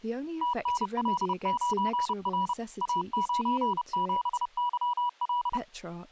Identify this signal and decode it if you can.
Morse code, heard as a keyed tone, machine-sent, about 30 wpm, 980 Hz, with speech in English. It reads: TNL9R A97YL